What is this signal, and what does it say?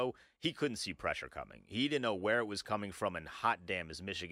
Speech in English. There is no code.